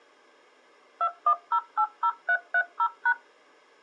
DTMF, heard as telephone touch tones, dialled by machine, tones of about 70 ms. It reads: 21080330#